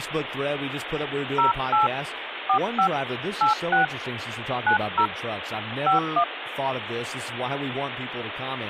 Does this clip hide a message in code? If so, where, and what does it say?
Yes: DTMF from 1.4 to 6.2 s, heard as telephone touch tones, dialled by hand, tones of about 110 ms, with phone line noise and speech in English. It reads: 08 45 86 90 51